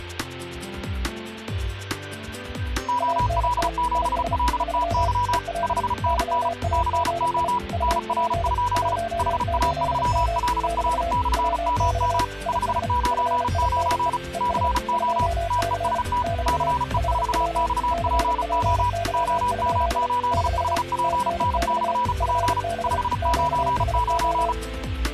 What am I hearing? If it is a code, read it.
Morse code, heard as two keyed tones. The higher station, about 35 wpm, 980 Hz: OL7LTY 5NN CO NR? HA3LR/MM 599 CO TEST CE4XPO OM8HPN/P 599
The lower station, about 33 wpm, 680 Hz: ANT IS 3 EL YAGI UP 18M <BT> WX IS FINE ES 2C <BT> HW CPY? <BT> TNX FB QSO